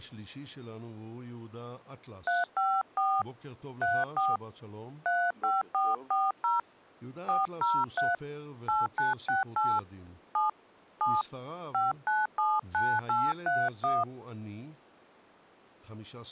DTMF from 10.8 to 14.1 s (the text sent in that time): 7 5979831